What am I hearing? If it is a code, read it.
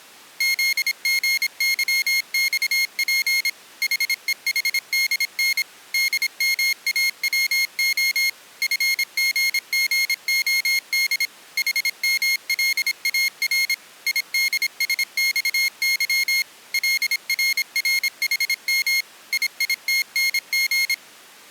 Morse code (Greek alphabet), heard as a high beeper, machine-sent, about 26 wpm, 2150 Hz. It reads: ΖΓΥΞΠ ΗΕΗΔΝ ΔΜΑΩΟ ΦΓΓΟΔ ΗΜΛΑΡ ΙΔΣΞΥ ΛΡΡΗΜ ΙΙΤΝΓ